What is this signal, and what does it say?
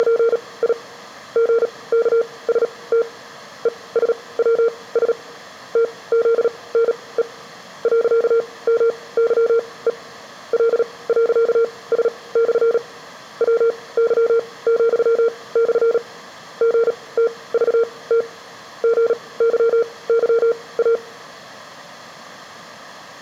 Morse code, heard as a keyed tone, machine-sent, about 37 wpm, spaced as for 22 wpm, 460 Hz. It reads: … GKST ESWS TZNE .MYE L.S/ WY,/ GTVT GYYA